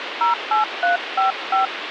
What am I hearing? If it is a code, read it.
DTMF, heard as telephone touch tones, dialled by hand, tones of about 130 ms, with phone line noise. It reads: 08355